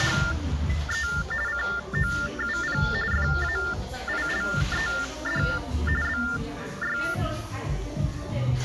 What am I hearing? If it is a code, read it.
TTY/TDD text telephone tones (45.45 baud Baudot), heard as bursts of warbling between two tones, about 400 Hz shift, 1600 Hz centre, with the noise of a cafe. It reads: … COUP FAILED BY